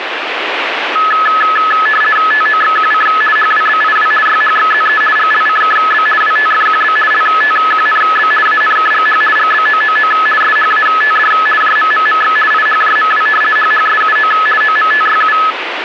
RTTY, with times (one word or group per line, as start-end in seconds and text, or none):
2.3-3.1 TOXQC
3.4-4.1 HWBIW
4.3-5.0 YHXZE
5.2-6.1 GLCKB
6.2-7.0 WTFQB
7.1-8.3 LTQNB
8.5-9.2 ANKGH
9.4-10.1 GBOOO
10.4-11.3 SHATD
11.6-12.4 JMMMX
12.5-13.3 IHJMW
13.6-14.3 HHSUO
14.6-15.4 OMTYU